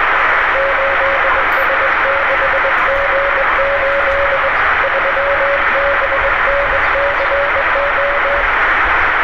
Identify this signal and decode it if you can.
Morse code, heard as a keyed tone, hand-sent with a straight key, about 21 wpm, 560 Hz, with heavy radio static, room echo and street noise. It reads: 8S6G8 3BNCO